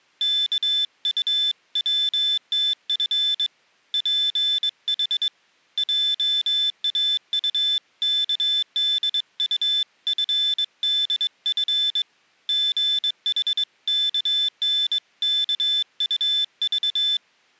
Morse code (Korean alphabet), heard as a high beeper, hand-sent with a straight key, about 22 wpm, 3500 Hz. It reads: 이번 주 회의는 수요일